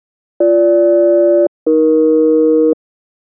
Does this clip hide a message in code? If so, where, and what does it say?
Yes: aircraft SELCAL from 0.4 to 2.7 s, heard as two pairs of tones. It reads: BG-AE